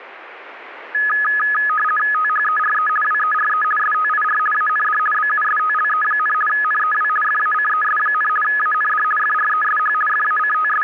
RTTY (50 baud, 450 Hz shift), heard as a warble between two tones, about 1480 Hz centre. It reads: THERE WERE STIR AND BUSTLE, NEW FACES, AND FRESH …